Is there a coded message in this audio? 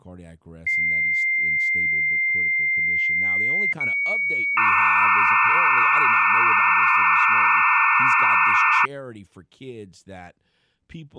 Yes: dial-up modem handshake (low-speed, two carriers) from 0.7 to 8.9 s, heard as two whistles, then hiss, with speech in English.